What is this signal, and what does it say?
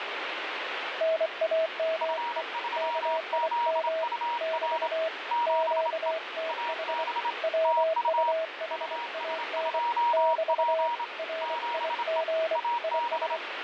Morse code, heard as two keyed tones, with radio static. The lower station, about 24 wpm, 650 Hz: NAME KIM <BT> QTH WUHAN <BT> RIG IS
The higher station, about 27 wpm, 950 Hz: F3ZUR 7E AB TU US2P 7E AB